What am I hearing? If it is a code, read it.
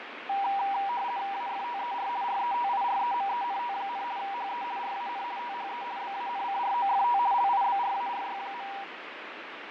RTTY (50 baud, 170 Hz shift), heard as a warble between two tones, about 880 Hz centre, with radio static and fading. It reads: AFTER RETIREMENT, HE RAN THE BANCROFT LIBRARY.